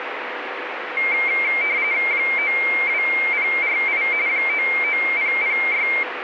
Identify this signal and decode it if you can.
RTTY (45.45 baud, 170 Hz shift), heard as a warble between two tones, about 2200 Hz centre, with radio static. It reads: 92048 99006